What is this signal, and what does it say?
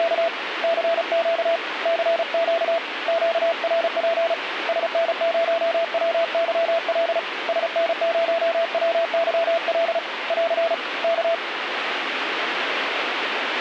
Morse code, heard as a keyed tone, hand-sent with a paddle, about 35 wpm, 670 Hz, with radio static. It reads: … CQ CQ QRP SN0WYL SN0WYL <AR> K